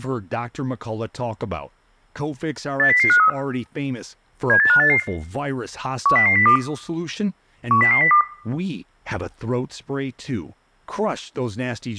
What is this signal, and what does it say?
Five-tone selective call (CCIR), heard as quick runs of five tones, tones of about 100 ms, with room echo and speech in English. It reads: 80053 78588 10002 10002